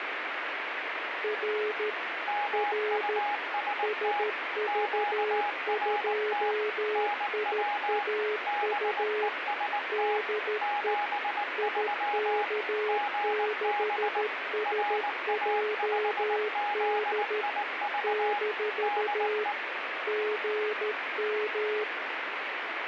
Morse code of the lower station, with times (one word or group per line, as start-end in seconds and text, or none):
1.2-1.9 R
2.5-3.2 R
3.8-9.3 SV2IAU
9.9-10.9 DE
11.6-17.4 IK6SJD
18.0-19.4 -
20.1-21.8 GM